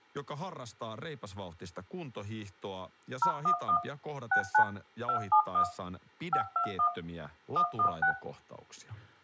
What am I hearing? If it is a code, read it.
DTMF, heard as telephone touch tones, dialled by machine, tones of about 90 ms, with speech in Finnish. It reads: 011 69 271 521 116